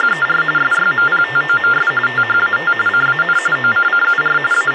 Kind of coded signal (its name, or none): TTY/TDD text telephone tones